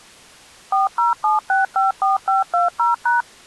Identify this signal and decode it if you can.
DTMF, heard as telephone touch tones, dialled by machine, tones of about 150 ms. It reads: 407654520#